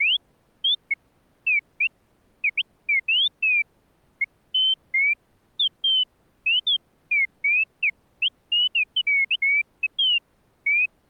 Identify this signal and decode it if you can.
Bird-like chirps. There is no code.